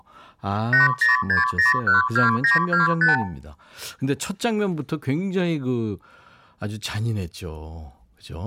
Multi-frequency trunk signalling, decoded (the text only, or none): 806012925